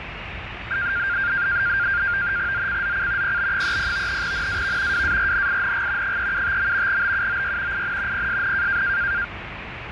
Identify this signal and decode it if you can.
NAVTEX (SITOR-B), 100 baud, 170 Hz shift, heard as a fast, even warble, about 1500 Hz centre, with radio static and the noise inside a subway train. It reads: ZCZC PB30 NAV WARNING 375. BUOY IN PSN